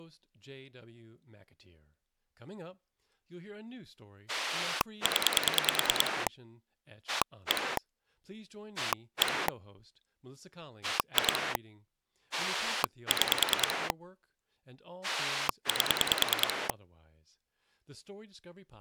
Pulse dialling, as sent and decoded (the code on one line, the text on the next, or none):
10 / 1 / 1 / 2 / 6 / 8
0 1 1 2 6 8